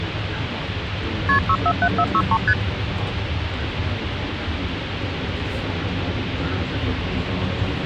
Multi-frequency trunk signalling (R1, as on North American trunks), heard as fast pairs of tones, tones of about 60 ms, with phone line noise and the noise inside a bus. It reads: KP 647463 ST